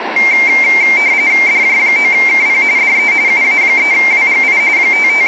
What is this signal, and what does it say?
RTTY (45.45 baud, 170 Hz shift), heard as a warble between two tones, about 2200 Hz centre, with radio static and room echo. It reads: DJ9KP DE UA3WGI …